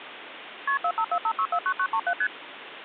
Multi-frequency trunk signalling (R1, as on North American trunks), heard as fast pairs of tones, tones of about 70 ms, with phone line noise. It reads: KP 4545649937 ST